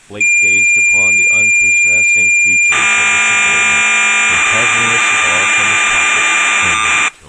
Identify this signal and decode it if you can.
Cassette data (Kansas City type), 1200 baud, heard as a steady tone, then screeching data, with speech in English.